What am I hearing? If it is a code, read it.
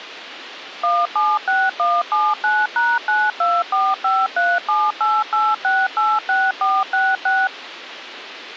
DTMF, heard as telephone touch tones, dialled by machine, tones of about 220 ms. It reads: 176179#92453788686466